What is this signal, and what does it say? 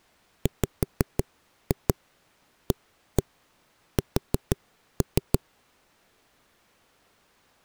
Tap code, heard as knocks on a wall, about 6 knocks a second. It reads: WAS